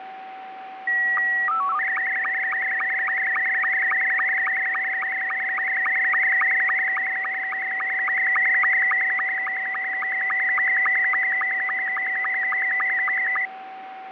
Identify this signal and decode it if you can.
SSTV (slow-scan television), Scottie S2, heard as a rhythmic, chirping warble, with radio static, fading and a steady whistle near 760 Hz.